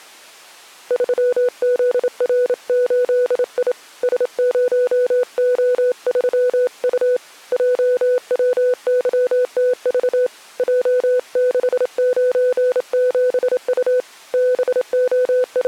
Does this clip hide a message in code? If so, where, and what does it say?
Yes: Morse code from 0.8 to 15.7 s, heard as a keyed tone, hand-sent with a straight key, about 27 wpm, 500 Hz. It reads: 3ZR8I S0O3U JWYTV J697U …